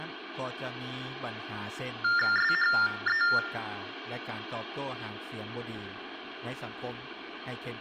TTY/TDD text telephone tones (45.45 baud Baudot), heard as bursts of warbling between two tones, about 400 Hz shift, 1600 Hz centre. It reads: SHE